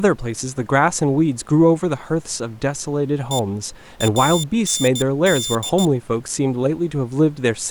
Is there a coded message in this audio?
Yes: Morse code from 3.3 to 5.9 s, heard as a high beeper, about 15 wpm, 3550 Hz, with speech in English. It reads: E AND